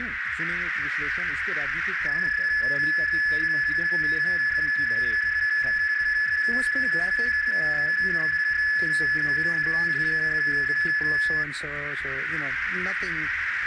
PSK31 (31.25 baud), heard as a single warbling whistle, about 1700 Hz, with radio static and a narrow filter.